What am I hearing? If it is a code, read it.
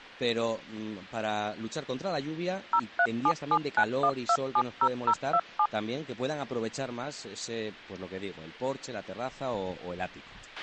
DTMF, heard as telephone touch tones, dialled by machine, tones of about 60 ms, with a squelch burst at the end. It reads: 037791270027